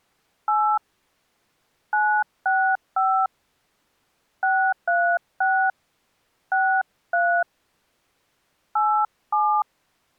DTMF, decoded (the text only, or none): 8 965 636 63 87